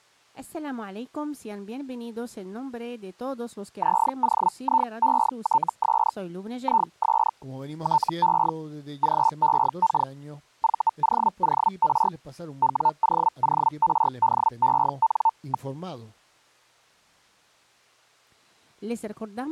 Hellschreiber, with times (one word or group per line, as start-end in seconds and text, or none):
3.8-6.1 ZOIETS
6.6-7.3 IS
7.8-8.5 TE
9.0-10.1 GEK
10.6-12.1 VOOR
12.6-15.7 WOORDEN.